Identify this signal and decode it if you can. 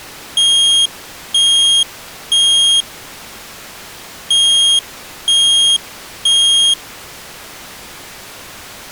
Alarm pattern, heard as an alarm's beeps, played twice, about 3250 Hz. Temporal three. Smoke or fire, evacuate.